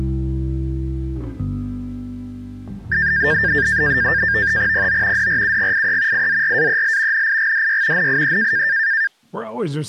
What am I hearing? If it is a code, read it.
NAVTEX (SITOR-B), 100 baud, 170 Hz shift, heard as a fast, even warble, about 1700 Hz centre. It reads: PO DRUGIE IZRAEL NIGDY NIE